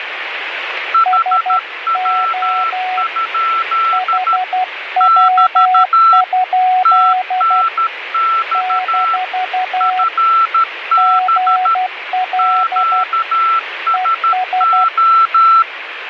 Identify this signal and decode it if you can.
Morse code, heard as two keyed tones, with radio static. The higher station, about 13 wpm, 1340 Hz: HW? <BT> TNX FB QSO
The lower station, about 12 wpm, 740 Hz: SO HW? - GL ES